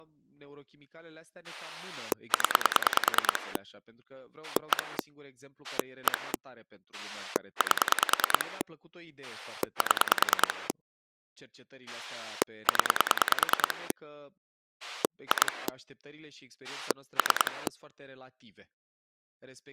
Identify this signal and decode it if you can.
Pulse dialling, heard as a rotary dial, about 10 pulses a second, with speech in Romanian. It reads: 0 1 1 8 7 0 2 3